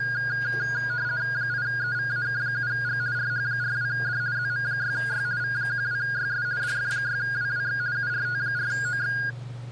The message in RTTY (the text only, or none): 8EVAK7G RH42D ZM6Y V12YS DF6WWX URT4OX